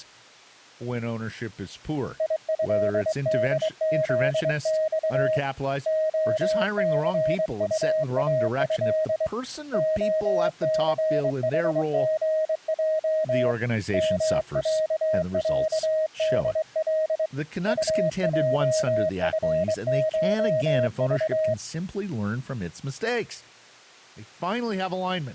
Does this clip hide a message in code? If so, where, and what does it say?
Yes: Morse code (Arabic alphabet) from 2.1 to 21.6 s, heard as a keyed tone, hand-sent with a straight key, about 23 wpm, 630 Hz, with speech in English. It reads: يهدذص خثطاه خثحغج مععدل طجفشض